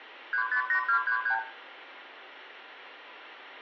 Multi-frequency trunk signalling (R2, with the far end's replies), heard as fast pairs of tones, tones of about 90 ms, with room echo. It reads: 358233